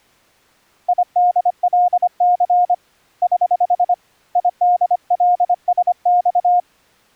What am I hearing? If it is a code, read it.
Morse code, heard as a keyed tone, hand-sent with a paddle, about 25 wpm, 710 Hz. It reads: IDLC <HH> IDLSX